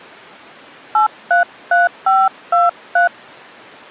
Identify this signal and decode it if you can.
DTMF, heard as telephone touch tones, dialled by hand, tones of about 170 ms. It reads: 833523